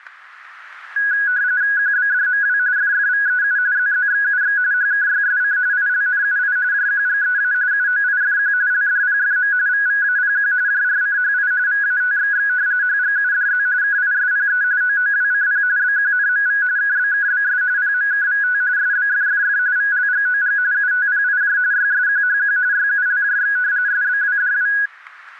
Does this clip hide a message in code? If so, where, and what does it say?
Yes: RTTY (45.45 baud, 170 Hz shift) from 1.0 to 24.9 s, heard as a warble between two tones, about 1550 Hz centre, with static crashes. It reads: QBDMW FFVEU ZZXUX HKYSC ILNUI JQGEA UOIFQ LDPFM VVAPQ JRCHI VATXX HGUDZ KISPE OOWCP BQNMV KBKBS PMKVT SBFFF VLGOG UTPIJ YSQHQ YULJX SBWDW